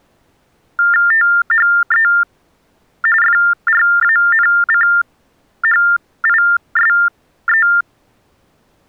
TTY/TDD text telephone tones (45.45 baud Baudot), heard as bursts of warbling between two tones, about 400 Hz shift, 1600 Hz centre. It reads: THE FRANCHISE